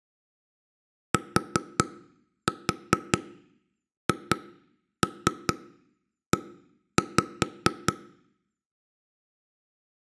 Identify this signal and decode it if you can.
Tap code, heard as knocks on wood, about 4 knocks a second, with room echo. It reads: THE